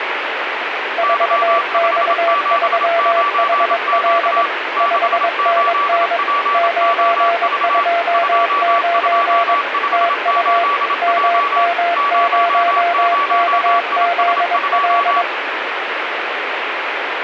Morse code, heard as two keyed tones, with radio static. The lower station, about 22 wpm, 680 Hz: 4X3HL 5NN 929 TU MM0KZL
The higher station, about 27 wpm, 1150 Hz: Y579Q 68POV 2258J 00IS2